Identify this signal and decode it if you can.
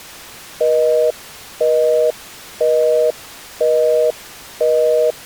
Telephone call progress tone (North American plan), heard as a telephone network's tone, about 480, 620 Hz, 0.5 s on and 0.5 s off. Busy tone.